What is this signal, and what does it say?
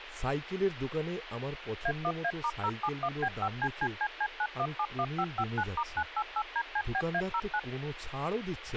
DTMF, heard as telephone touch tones, dialled by machine, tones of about 60 ms, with radio hiss, a squelch burst at the end and speech in Bangla. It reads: A1A*071B5CCCC9171559*988DCBA09